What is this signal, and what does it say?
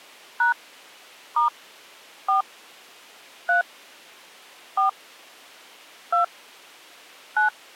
DTMF, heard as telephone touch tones, dialled by hand, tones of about 120 ms. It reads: # * 4 3 4 2 9